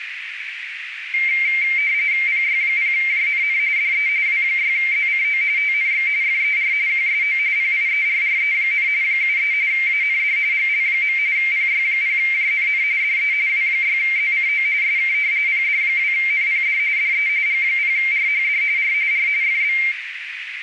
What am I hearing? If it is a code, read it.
RTTY (45.45 baud, 170 Hz shift), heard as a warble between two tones, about 2200 Hz centre, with radio static and a narrow filter. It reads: PY0JNN DE W6ZCO TNX FER QSO PIERRE, 73 AND GL. PY0JNN DE W6ZCO SK PD2NPD DE G0RHD R R FB